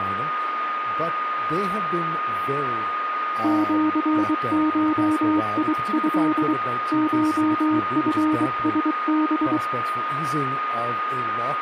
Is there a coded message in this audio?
Yes: Morse code (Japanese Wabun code) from 3.4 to 9.6 s, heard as a keyed tone, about 23 wpm, 310 Hz, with radio static, a steady whistle near 1230 Hz and speech in English. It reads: シゴト コチラハ